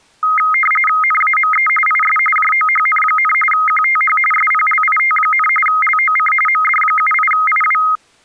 RTTY (45.45 baud, 850 Hz shift), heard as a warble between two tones, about 1700 Hz centre. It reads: NAME IS JOHN, QTH SPLIT, LOC MD78IW